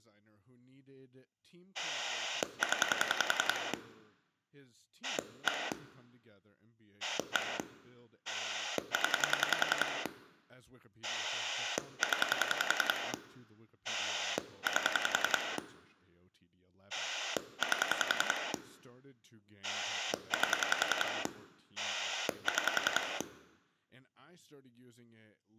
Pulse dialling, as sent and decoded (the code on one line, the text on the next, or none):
10 / 1 / 1 / 10 / 10 / 8 / 8 / 8 / 6
0 1 1 0 0 8 8 8 6